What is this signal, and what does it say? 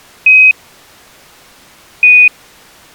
Quindar tones, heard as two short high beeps.